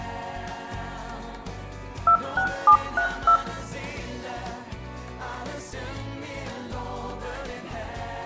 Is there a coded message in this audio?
Yes: DTMF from 2.1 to 3.4 s, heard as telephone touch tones, dialled by machine, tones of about 90 ms, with room echo. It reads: 26732